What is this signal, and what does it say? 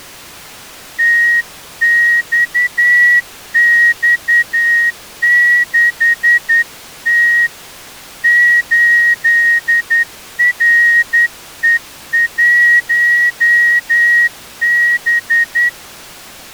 Morse code, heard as a whistle, hand-sent with a straight key, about 10 wpm. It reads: TXX6T 8RE1B